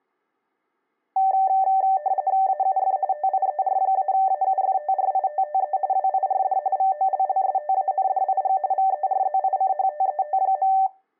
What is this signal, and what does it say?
RTTY (45.45 baud, 170 Hz shift), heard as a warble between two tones, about 680 Hz centre. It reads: AUF TIER-AUFTRITTE WIRD VOLLSTANDIG VERZICHTET.